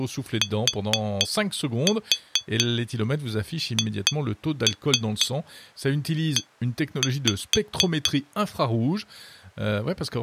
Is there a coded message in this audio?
Yes: tap code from 0.4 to 8.2 s, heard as taps on glass, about 4 knocks a second, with speech in French. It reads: THE